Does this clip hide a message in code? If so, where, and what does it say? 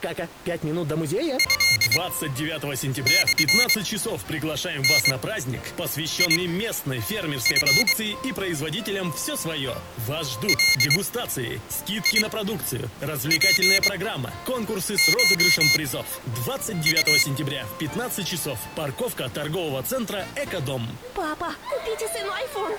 Yes: Morse code (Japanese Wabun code) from 1.3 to 17.3 s, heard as a high beeper, machine-sent, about 23 wpm, spaced as for 7 wpm, 2150 Hz. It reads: トモダチ ガツコウ